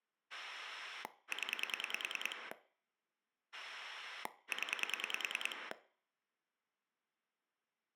Pulse dialling, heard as a rotary dial, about 10 pulses a second, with room echo. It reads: 0 0